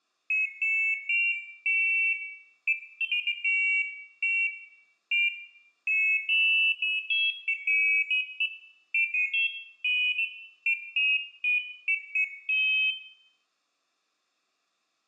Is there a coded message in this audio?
No, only pairs of high tones at irregular times, with room echo.